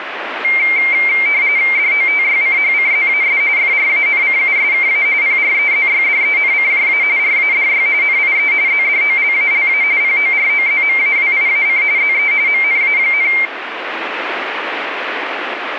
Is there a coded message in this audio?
Yes: RTTY (45.45 baud, 170 Hz shift) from 0.4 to 13.5 s, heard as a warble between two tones, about 2200 Hz centre, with radio static. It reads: DOTYCHCZAS FRANCUSKA PREZYDENCJA RADY NIE ZDOLALA POROZMAWIAC ZE MNA,